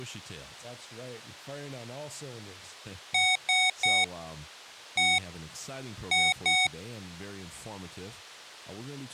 Beep code, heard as beeps from a small speaker, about 740 Hz, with speech in English. 3-1-2. In Phoenix BIOS tables: DMA register failure.